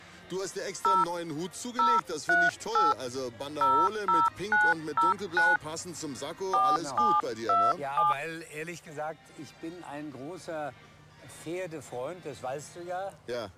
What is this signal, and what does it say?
DTMF, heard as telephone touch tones, dialled by hand, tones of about 200 ms. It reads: 0 038 00909 4727